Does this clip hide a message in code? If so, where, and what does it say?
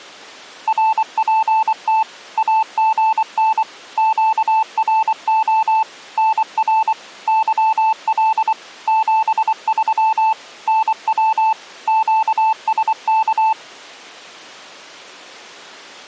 Yes: Morse code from 0.6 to 13.6 s, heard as a keyed tone, machine-sent, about 24 wpm, 880 Hz. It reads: RPT AGN QRO NR YL 73 NW QSK